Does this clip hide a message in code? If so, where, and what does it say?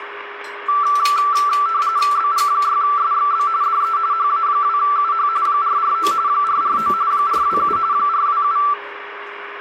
Yes: RTTY (45.45 baud, 170 Hz shift) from 0.7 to 8.7 s, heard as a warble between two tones, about 1250 Hz centre, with radio static, a steady whistle near 410 Hz and kitchen noise. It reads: BG6SXB DE HA2UH 449 449 427 427